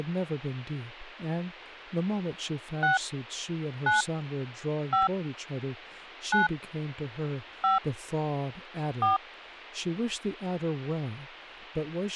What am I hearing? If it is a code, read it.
DTMF, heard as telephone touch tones, dialled by hand, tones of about 150 ms, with speech in English. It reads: 6 9 5 9 5 4